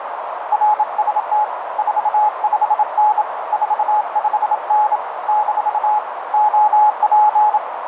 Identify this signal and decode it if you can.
Morse code, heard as a keyed tone, hand-sent with a bug key, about 27 wpm, 850 Hz, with radio static and a narrow filter. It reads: RST 45N 45N - OP